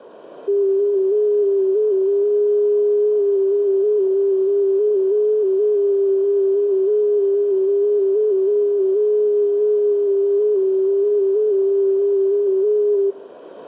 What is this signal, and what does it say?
FT8 (one signal), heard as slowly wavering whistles, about 6.25 baud, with radio static.